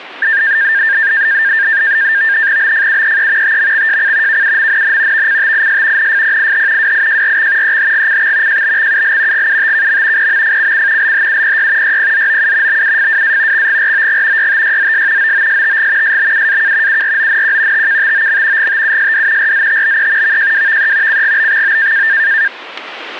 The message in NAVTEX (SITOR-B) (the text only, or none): BFUEE TMXJC KUMNN VCTIS NFPIH WIJRX EHGCX JBXUL GUTKM PMFCC LHUPY YPZOU BUFWA XGROG YTYZS OOSTG SBUAK URONQ TKTOM GTUSD RZTBE VJWVE CGBXO